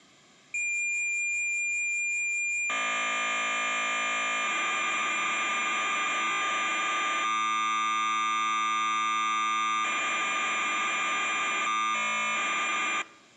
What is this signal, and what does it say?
Cassette data (Kansas City type), 1200 baud, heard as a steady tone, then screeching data.